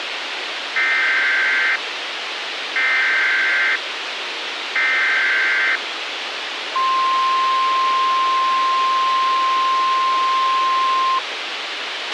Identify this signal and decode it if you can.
Emergency Alert System (SAME) tones (header bursts, then the 1050 Hz attention tone), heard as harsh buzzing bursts, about 520.83 baud, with radio hiss and a squelch burst at the end.